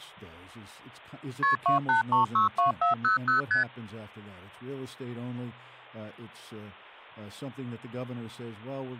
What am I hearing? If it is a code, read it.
Multi-frequency trunk signalling (R1, as on North American trunks), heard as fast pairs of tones, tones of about 130 ms, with speech in English. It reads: KP 28362400 ST